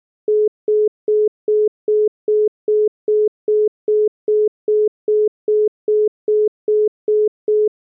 Telephone call progress tone (single-tone plan, as in most of Europe), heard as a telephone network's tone, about 420 Hz, 0.2 s on and 0.2 s off. Congestion tone.